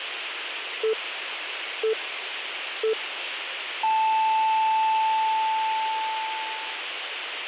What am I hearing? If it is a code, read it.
Radio time signal (three low pips and a long one an octave up, as on NHK), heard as pips, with radio hiss.